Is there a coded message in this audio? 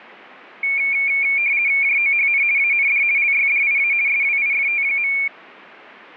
Yes: RTTY (50 baud, 170 Hz shift) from 0.6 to 5.3 s, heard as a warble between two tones, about 2300 Hz centre. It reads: JOHN AND LYDIA SWIFT.